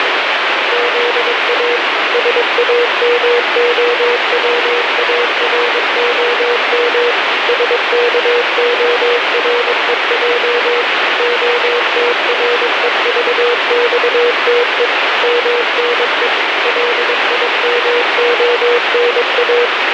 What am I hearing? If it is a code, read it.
Morse code (Russian alphabet), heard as a keyed tone, machine-sent, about 22 wpm, 480 Hz, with heavy radio static. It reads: ЗА САМОВАРОМ СКОРЕЙ ОТРЕЖЬТЕ МНЕ ЛИМОНА